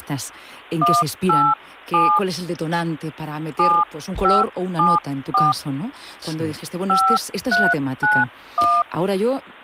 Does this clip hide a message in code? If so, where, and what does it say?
Yes: DTMF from 0.8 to 8.8 s, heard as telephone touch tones, dialled by hand, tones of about 220 ms, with speech in Spanish. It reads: 187 7574 5391